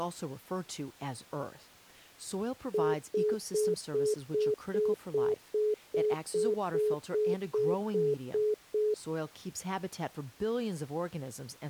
Telephone call progress tone (single-tone plan, as in most of Europe), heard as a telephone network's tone, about 420 Hz, 0.2 s on and 0.2 s off, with speech in English. Congestion tone.